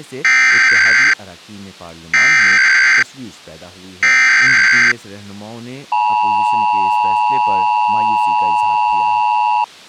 Emergency Alert System (SAME) tones (header bursts, then the 853 and 960 Hz attention tone), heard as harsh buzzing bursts, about 520.83 baud, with speech in Urdu.